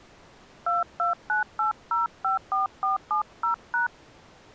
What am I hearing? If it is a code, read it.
DTMF, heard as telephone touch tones, dialled by hand, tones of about 140 ms. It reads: 2298054470#